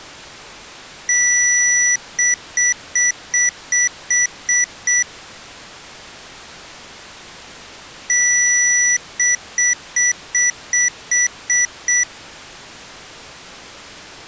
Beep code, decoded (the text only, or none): 1 long, 8 short